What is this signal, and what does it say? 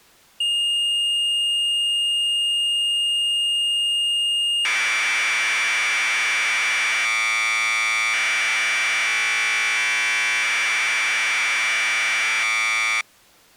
Commodore tape loading (standard loader), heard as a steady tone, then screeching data.